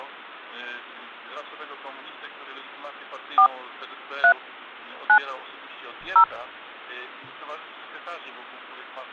DTMF, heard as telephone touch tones, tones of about 80 ms. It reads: 4 3 9 0